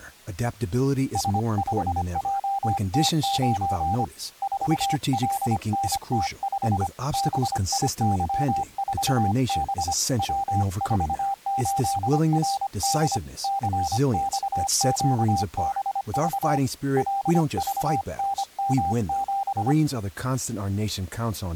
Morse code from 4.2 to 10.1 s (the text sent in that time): 4LNT5 BIY4B